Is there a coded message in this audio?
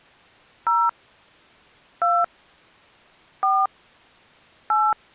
Yes: DTMF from 0.7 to 4.9 s, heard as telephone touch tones, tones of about 230 ms. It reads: 0 2 4 8